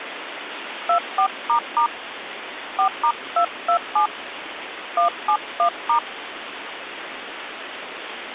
DTMF, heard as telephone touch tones, dialled by hand, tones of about 100 ms, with phone line noise. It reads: 24** 4*227 171*